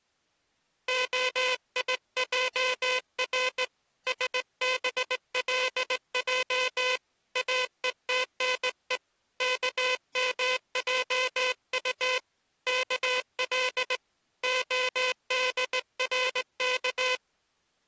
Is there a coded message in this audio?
Yes: Morse code (Hebrew alphabet) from 0.8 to 17.2 s, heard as a buzzer, hand-sent with a straight key, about 18 wpm. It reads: היער שבלע אותנו כמעט כל הדרך